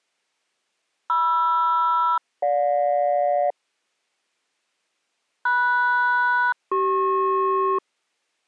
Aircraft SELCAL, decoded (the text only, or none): MR-GJ MS-CP